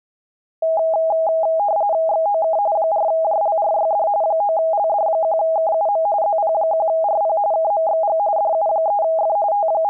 RTTY (45.45 baud, 170 Hz shift), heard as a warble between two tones, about 730 Hz centre. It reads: XOK 4JLRYD 9LD1KUM ZP1RP KMXG DU3F …